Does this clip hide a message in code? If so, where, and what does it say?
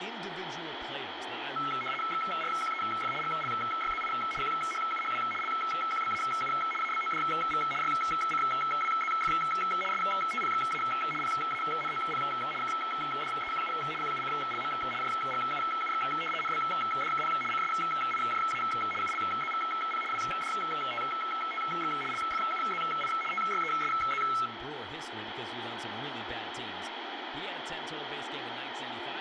Yes: RTTY (75 baud, 850 Hz shift) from 1.6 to 24.5 s, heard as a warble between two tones, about 1750 Hz centre, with radio static and speech in English. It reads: XRQEF GLYZI QHUHW LQBAU ABODV YCWZF STPXA PANOP KDEQU QUCLM JGUUX NBDKP CSIJA ULZVP WDTTX LFUZI TYESZ